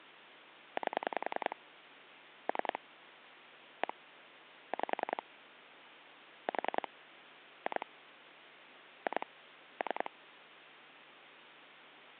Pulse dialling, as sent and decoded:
8 / 3 / 1 / 5 / 4 / 2 / 2 / 3
8 3 1 5 4 2 2 3

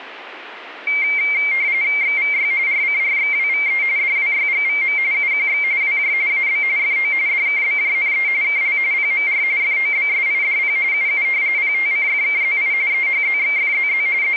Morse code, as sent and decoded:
none

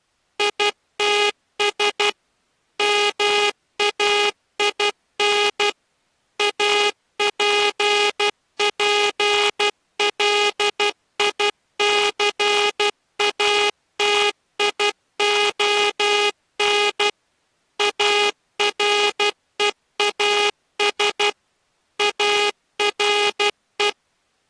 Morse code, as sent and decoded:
.. - ... / -- .- .. -. / .- .--. .--. .-.. .. -.-. .- - .. --- -. / .- .-. . .- ... / .- .-. .
ITS MAIN APPLICATION AREAS ARE

